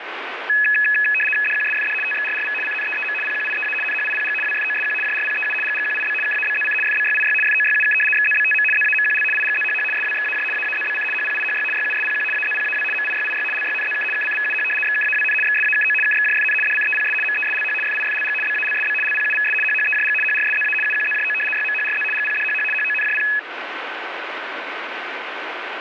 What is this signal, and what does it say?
RTTY (75 baud, 850 Hz shift), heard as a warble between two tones, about 2100 Hz centre, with radio static. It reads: DQSFD TXRRV CNEEM PQIEA NHIPG WFOSQ JRPEU GGQIB KABZC FBYIY FOYUK XZBTM ZAMQL IGZHH SWXAJ AAZBC HPIHY YUSPQ AZPAW MIYIY LYNZK KCVUH XKAWN XSAKO KXJFN DCEPS MESLH FIFLG BALSB LPUVS HHEJG HRSZA UQZJO YMHRZ GPDHH HONJP